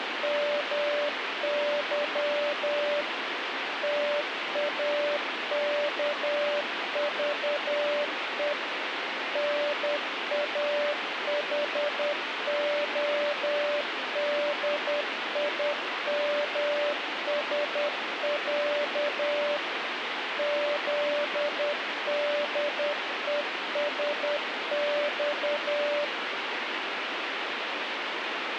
Morse code (Russian alphabet), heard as a keyed tone, machine-sent, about 10 wpm, 590 Hz, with radio static. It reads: МЫ ТАКЖЕ НАХОДИМСЯ ЗДЕСЬ